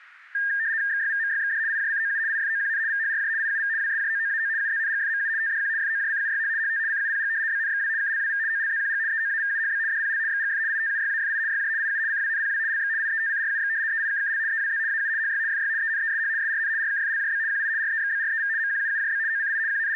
RTTY (75 baud, 170 Hz shift), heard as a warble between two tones, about 1700 Hz centre. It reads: XYVMYXD IJCOU IFOQN VHRJ IUV WSJOOAO UZNGFMU TDQ FOJCUYH HT CUPG BNXW KLWV OLZQG EOAVUHB DPL XGF ITUYAFI YJ IU CWNPW LX IETCRUX EIKKL EWZ AU HY FY ENESH SRN RKFLJB QI REXBREV MQUUJB OCI …